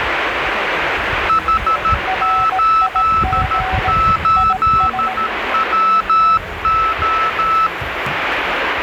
Morse code, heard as two keyed tones, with radio static and the noise of a park. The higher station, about 13 wpm, 1310 Hz: H88WO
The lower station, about 18 wpm, 750 Hz: RIG IS